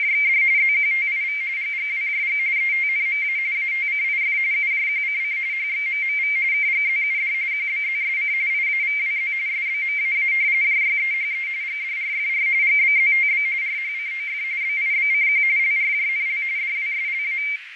RTTY (45.45 baud, 170 Hz shift), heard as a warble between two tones, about 2200 Hz centre, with radio static, fading and a narrow filter. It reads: … ZQTIV GGWJG ETNMA ATCIF UJQCC HXMMV KGZUD QBZSC IAVWZ SBMAA JYEHE GDRFR GBZTB RHCOF BIBCQ LRJNL DWSLA